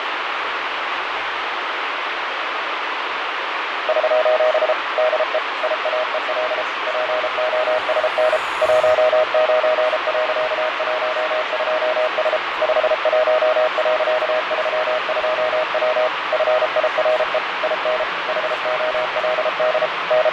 Morse code, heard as a keyed tone, machine-sent, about 33 wpm, 620 Hz, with heavy radio static and fading. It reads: <SOS> DE IAEL POSN 19.12S 51.32W FIRE IN HOLD …